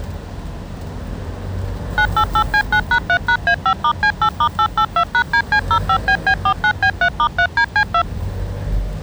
DTMF, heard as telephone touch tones, dialled by machine, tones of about 80 ms, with the noise inside a car. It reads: 988C9#3#A5*C8*882#DC05BB49B3*3DC2